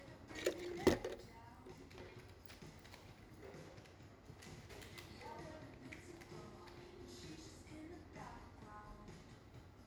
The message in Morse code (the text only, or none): none